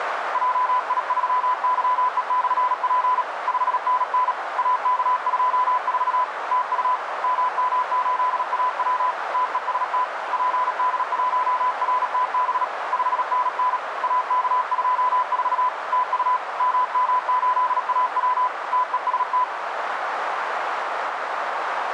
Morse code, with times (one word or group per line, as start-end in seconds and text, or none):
0.3-3.2 JI3YE/P
3.5-4.3 5NN
4.6-6.2 AK24
6.5-7.0 TU
7.2-9.1 MM8AW
9.3-10.0 TEST
10.3-12.6 PD1RTB
12.9-13.8 5NN
14.0-15.7 AK24
15.9-16.4 TU
16.6-18.5 MM8AW
18.7-19.4 TEST